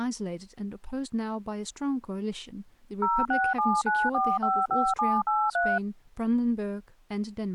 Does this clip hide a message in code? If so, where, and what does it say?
Yes: DTMF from 3.0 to 5.8 s, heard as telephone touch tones, dialled by machine, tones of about 230 ms, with speech in English. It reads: 0679455783